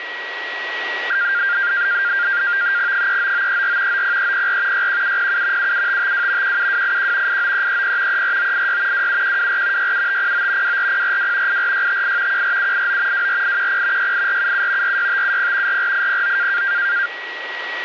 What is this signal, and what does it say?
NAVTEX (SITOR-B), 100 baud, 170 Hz shift, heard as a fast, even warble, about 1500 Hz centre, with radio static and a steady whistle near 1920 Hz. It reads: 39934 90304 61707 77552 17281 89330 34986 27124 67509 24042 84658 14789 24810 68477 46570 44809